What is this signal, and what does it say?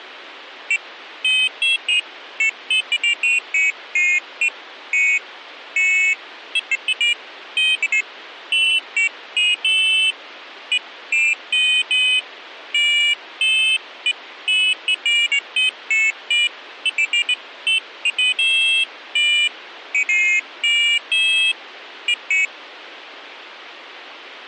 Pairs of high tones at irregular times. There is no code.